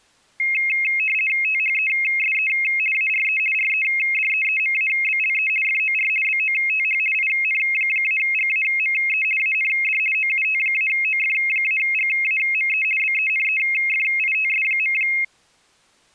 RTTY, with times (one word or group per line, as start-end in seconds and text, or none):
1.4-2.5 THESE
2.9-3.4 ARE
3.5-5.5 REDEEMABLE
5.6-6.1 FOR
6.2-7.0 BOTH
7.1-9.2 IN-GAME
9.4-10.0 AND
10.1-12.8 OUT-OF-GAME
13.0-14.9 BENEFITS.